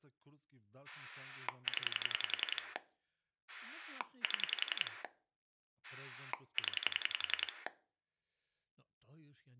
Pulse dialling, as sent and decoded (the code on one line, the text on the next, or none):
10 / 7 / 10
0 7 0